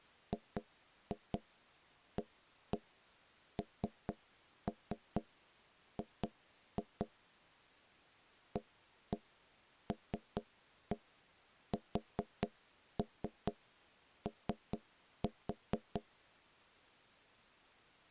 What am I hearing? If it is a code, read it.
Tap code, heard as knocks on wood, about 4 knocks a second. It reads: GANG ALSO